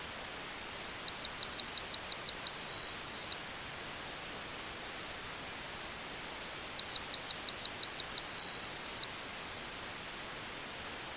Beep code, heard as a piezo beeper, played twice, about 4200 Hz. 4 short, 1 long.